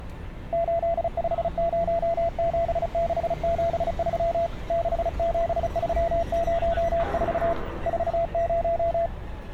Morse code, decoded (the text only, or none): 8507673 67304 40